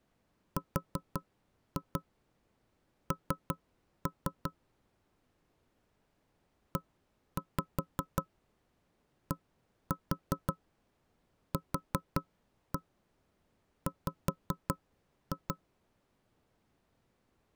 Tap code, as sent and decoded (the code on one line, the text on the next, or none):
4-2 3-3 / 1-5 1-4 4-1 5-2
RN EDQW